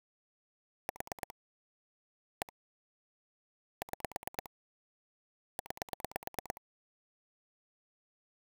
Pulse dialling, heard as clicks on a phone line, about 9 pulses a second. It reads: 4 1 6 9